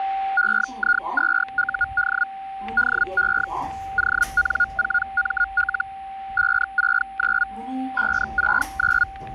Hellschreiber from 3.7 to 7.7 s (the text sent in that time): ON4ML 569